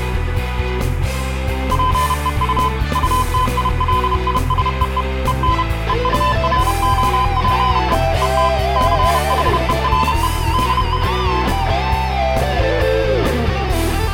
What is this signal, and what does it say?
Morse code, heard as a keyed tone, machine-sent, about 31 wpm, 1020 Hz, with room echo. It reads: PEU UTILISEE EN EUROPE ET CHERE DE